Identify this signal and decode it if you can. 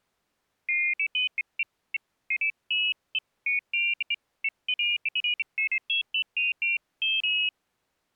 Pairs of high tones at irregular times. There is no code.